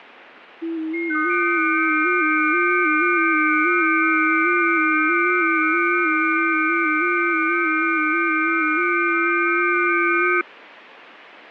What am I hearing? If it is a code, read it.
FT8 (several signals at once), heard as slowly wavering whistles, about 6.25 baud, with radio static.